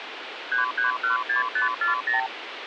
Multi-frequency trunk signalling (R2, with the far end's replies), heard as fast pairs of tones, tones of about 130 ms, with phone line noise. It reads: 3316540